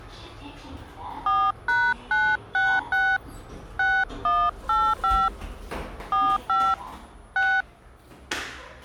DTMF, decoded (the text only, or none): 4#966 6185 45 6